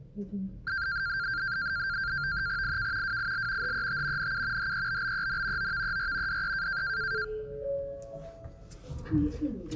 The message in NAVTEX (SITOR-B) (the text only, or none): IK WIL HET NU HEBBEN OVER DE